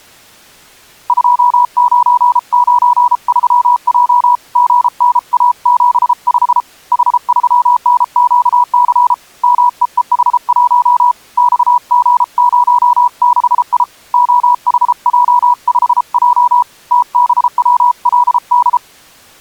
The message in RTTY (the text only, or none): none